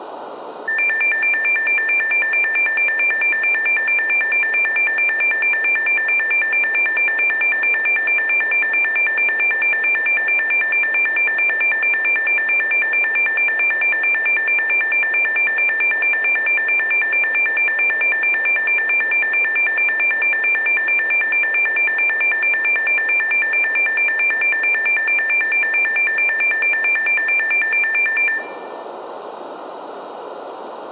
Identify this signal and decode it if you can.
A tone that alternates evenly between two pitches, with room echo. There is no code.